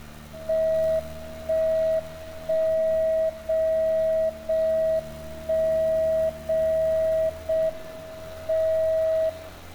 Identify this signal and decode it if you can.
Radio time signal (JJY), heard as a tone whose level steps once a second, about 640 Hz, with room echo and street noise. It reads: 1 1 0 0 1 0 0 M 0